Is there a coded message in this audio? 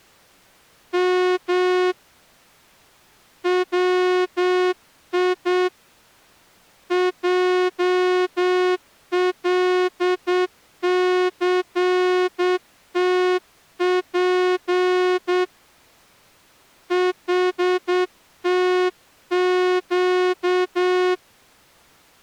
Yes: Morse code (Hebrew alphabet) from 0.9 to 21.2 s, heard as a horn, hand-sent with a straight key, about 8 wpm. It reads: מ צי עלסתף חתק